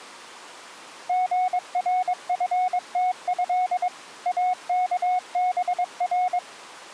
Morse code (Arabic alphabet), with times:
1.1-3.9 غرفته
4.3-6.4 اكبر

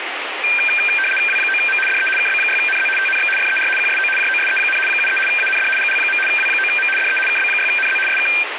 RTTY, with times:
1.3-1.8 W9M
1.9-2.1 DE
2.2-2.9 KB6NZ
3.0-3.3 TNX
3.4-3.7 FER
3.8-4.1 QSO
4.2-4.8 JOSE,
4.9-5.2 73
5.3-5.7 AND
5.8-6.2 GL.
6.3-6.9 W9M
7.0-7.2 DE
7.3-8.0 KB6NZ
8.1-8.3 SK

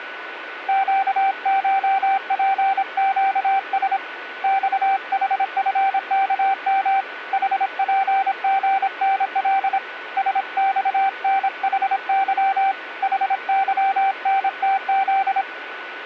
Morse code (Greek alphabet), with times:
0.7-4.0 ΨΧΠΨΣ
4.4-7.0 ΞΗΦΚΜ
7.3-9.8 ΗΠΓΝΛ
10.2-12.7 ΣΞΝΗΥ
13.0-15.4 ΗΥΝΤΖ

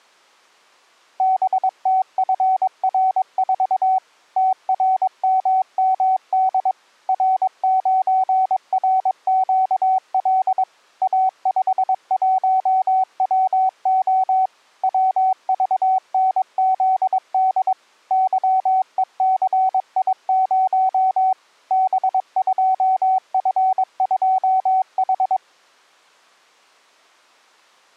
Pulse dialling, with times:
none

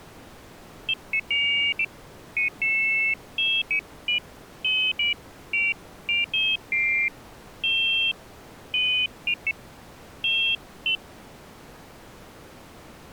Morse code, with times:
none

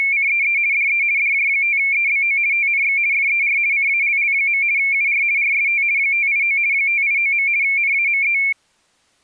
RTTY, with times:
0.0-0.6 …
0.7-1.0 DE
1.2-2.4 DJ5EBO
2.5-3.0 TNX
3.1-3.6 FER
3.7-4.6 CALL.
4.8-5.2 UR
5.4-5.8 RST
6.0-6.6 589
6.7-7.5 589.
7.6-8.4 NAME

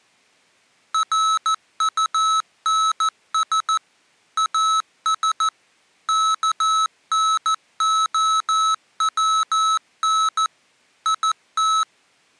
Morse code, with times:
0.9-3.8 RUNS
4.4-5.5 AS
6.1-10.5 KNOWN
11.1-11.8 IT

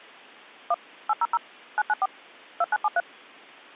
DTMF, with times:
0.7-0.7 1
1.1-1.4 800
1.8-2.1 994
2.6-3.0 2973

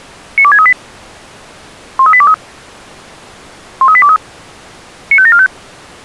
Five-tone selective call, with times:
0.4-0.7 92638
2.0-2.3 13823
3.8-4.2 13823
5.1-5.5 95745

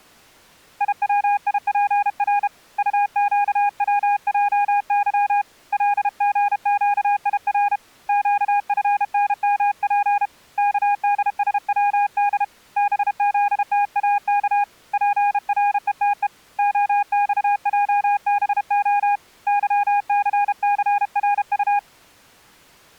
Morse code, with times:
0.8-2.5 IWIPR
2.8-5.4 UQWJY
5.7-7.8 LGQIR
8.1-10.3 QFNMP
10.6-12.4 KDSWD
12.8-14.6 BZTAK
14.9-16.3 PRETE
16.6-19.2 OXJBO
19.5-21.8 YCCRU

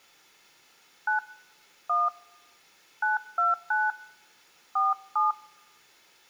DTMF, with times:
1.1-1.2 9
1.9-2.1 1
3.0-3.9 929
4.8-5.3 47

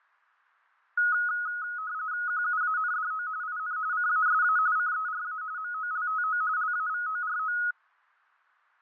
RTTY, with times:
2.3-3.3 QUANDO
3.4-3.8 IN
3.9-4.6 CASA
4.8-5.4 CERA
5.6-6.4 MOLTO
6.6-7.6 LAVORO

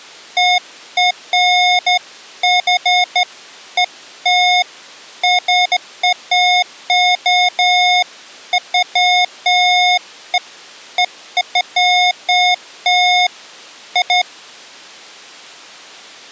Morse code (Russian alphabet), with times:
none

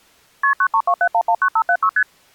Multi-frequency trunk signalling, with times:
0.4-0.5 KP
0.6-1.9 9327119576
2.0-2.0 ST

